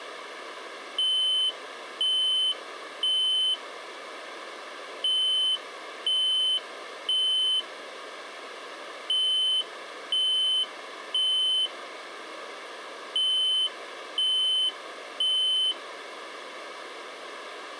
Alarm pattern, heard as an alarm's beeps, played four times, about 3050 Hz. Temporal three. Smoke or fire, evacuate.